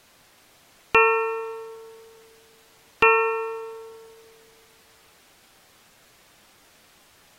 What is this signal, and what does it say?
Clock strike, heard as a bell. 2. Two o'clock.